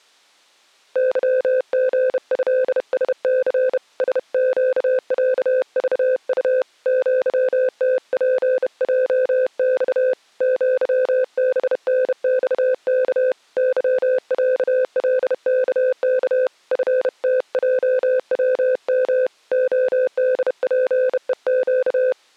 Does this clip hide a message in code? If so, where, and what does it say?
Yes: Morse code (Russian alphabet) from 0.9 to 22.2 s, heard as a keyed tone, hand-sent with a bug key, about 31 wpm, 510 Hz. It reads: ЫГЭСЦ СЩЯЖУ ЪТПЙЬ ЪБНЬК ЫЯЛКК ФТЙВМ ОДПЕЩ